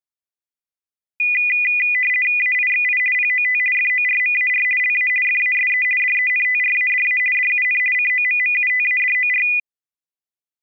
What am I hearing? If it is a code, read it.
RTTY (50 baud, 450 Hz shift), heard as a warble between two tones, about 2250 Hz centre. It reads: AIXI POT FORMAR LA FASE DENTRADA DUN COMMUTADOR